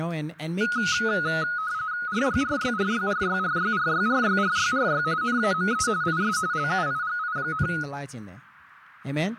RTTY (45.45 baud, 170 Hz shift), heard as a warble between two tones, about 1360 Hz centre, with speech in English. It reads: RYRYRYRYRYRYRYRYRY NAME IS LUIGI,